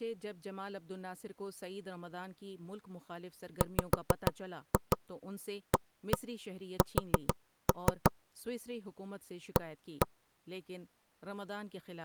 Tap code, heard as knocks on wood, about 6 knocks a second, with speech in Urdu. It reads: WAS A